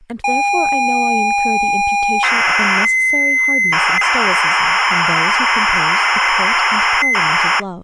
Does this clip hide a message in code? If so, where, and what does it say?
Yes: ZX Spectrum tape loading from 0.2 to 7.6 s, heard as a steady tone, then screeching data, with speech in English.